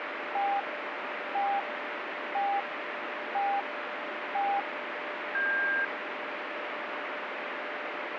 Radio time signal (five pips and a higher one, as on Chinese radio), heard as pips, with radio static.